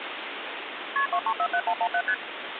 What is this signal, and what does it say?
Multi-frequency trunk signalling (R1, as on North American trunks), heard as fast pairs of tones, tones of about 70 ms, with phone line noise. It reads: KP 2347117 ST